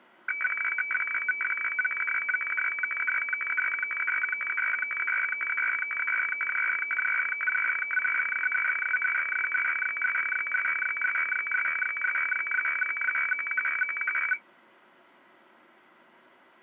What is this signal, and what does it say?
Weather fax (radiofax), 120 lines a minute, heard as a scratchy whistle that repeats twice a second.